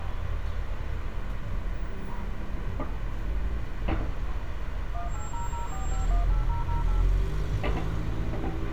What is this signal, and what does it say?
DTMF, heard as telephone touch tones, dialled by machine, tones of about 140 ms, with radio hiss, a squelch burst at the end, room echo and street noise. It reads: 18004518008